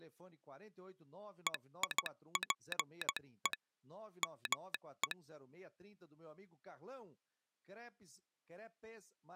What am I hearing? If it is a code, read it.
Morse code (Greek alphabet), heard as a telegraph sounder, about 16 wpm, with speech in Portuguese. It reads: ΕΙΠΕ ΜΕ